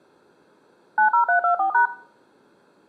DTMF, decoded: 90324#

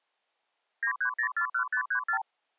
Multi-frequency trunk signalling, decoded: 93041534

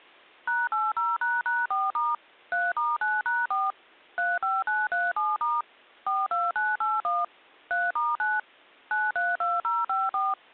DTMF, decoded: #80##4* 3*9#4 35937* 42981 3*9 932054

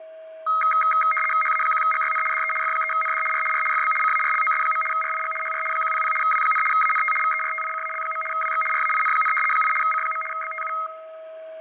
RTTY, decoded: HA1GYN DE F3ND R R FB CARLOS. RIG HR 100 W, ANT VERTICAL. WX RAIN, 8 C. BTU

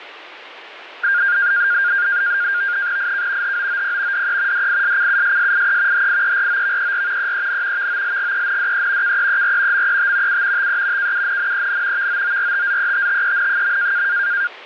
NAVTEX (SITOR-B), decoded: IK HOOP DE DISCUSSIE HIEROVER EEN VOLGENDE KEER MET U TE KUNNEN VOORTZETTEN.

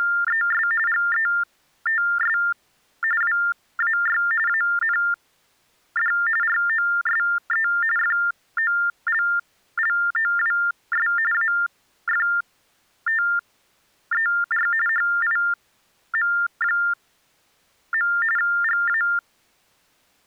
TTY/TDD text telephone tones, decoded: … GETS WAY AND ROSE FOLLOWS AFTER HIM. GA

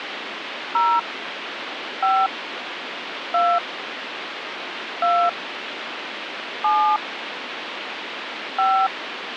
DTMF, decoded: 0 5 2 2 7 5

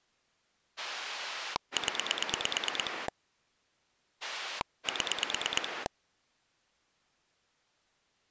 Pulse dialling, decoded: 0 7

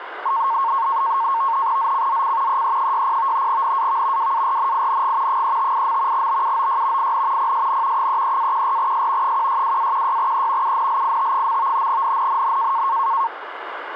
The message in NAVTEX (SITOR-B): ZCZC EE60 NAV WARNING 358. BUOY IN PSN 33-14S 162-16E UNLIT. NNNN

